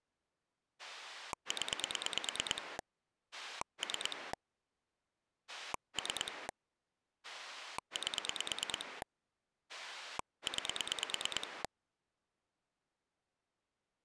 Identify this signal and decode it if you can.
Pulse dialling, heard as a rotary dial, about 9 pulses a second. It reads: 0 3 3 8 9